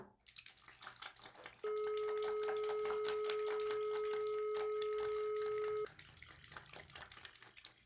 Telephone call progress tone (425 Hz plan, as in most of Europe), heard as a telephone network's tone, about 420 Hz, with the noise of a restroom. Dial tone.